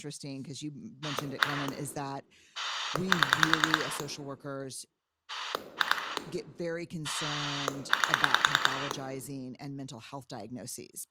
Pulse dialling, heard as a rotary dial, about 10 pulses a second, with room echo and speech in English. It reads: 1 7 2 8